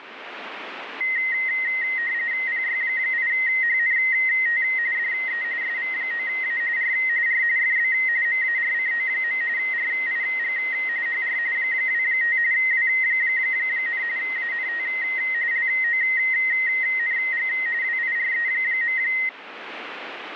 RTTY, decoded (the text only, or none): PY8HNT DE SV9A R R FB MARCO. RIG HR 25 W, ANT LONG WIRE.